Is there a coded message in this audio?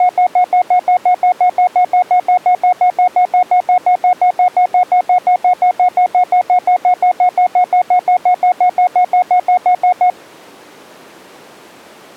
No, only evenly repeated beeps.